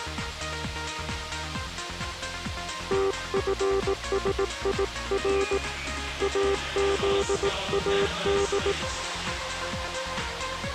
Morse code (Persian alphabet), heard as a keyed tone, hand-sent with a paddle, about 18 wpm, 390 Hz. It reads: تفسیر ازاد